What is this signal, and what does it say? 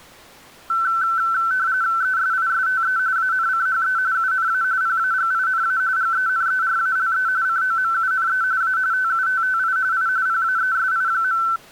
RTTY (45.45 baud, 170 Hz shift), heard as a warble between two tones, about 1430 Hz centre. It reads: ESISTE ANCHE UNA PAGINA GENERALE COMUNE A TUTTI I PAESI.